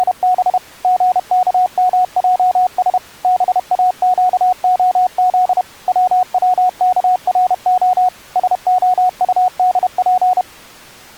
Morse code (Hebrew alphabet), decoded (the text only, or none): … גכמעש באקהז צצכרה שהטדף